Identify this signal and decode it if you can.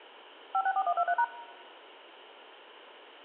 DTMF, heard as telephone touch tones, dialled by machine, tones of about 60 ms, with room echo. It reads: 564123#